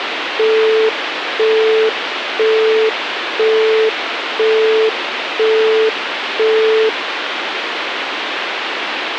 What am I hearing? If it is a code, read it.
Telephone call progress tone (single-tone plan, as in Europe, Japan and elsewhere), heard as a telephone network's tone, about 440 Hz, 0.5 s on and 0.5 s off, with phone line noise. Busy tone.